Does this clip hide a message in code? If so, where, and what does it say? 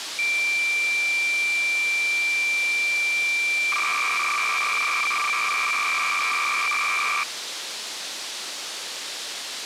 Yes: cassette data (Kansas City type), 300 baud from 0.2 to 7.2 s, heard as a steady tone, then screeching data, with tape hiss.